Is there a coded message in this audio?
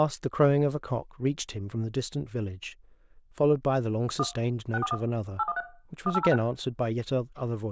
Yes: DTMF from 4.2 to 6.4 s, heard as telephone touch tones, dialled by machine, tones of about 40 ms, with room echo and speech in English. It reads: 1 641 813 1806